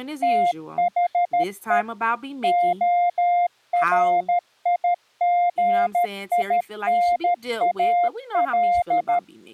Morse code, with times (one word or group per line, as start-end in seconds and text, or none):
0.2-1.8 THE
2.4-9.2 ORIGINAL